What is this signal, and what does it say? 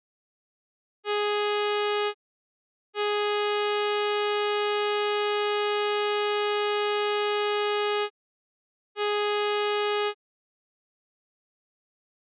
Ship horn signal, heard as a ship's horn, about 420 Hz. 1 short, 1 long, 1 short. At sea: a vessel at anchor warns of its position.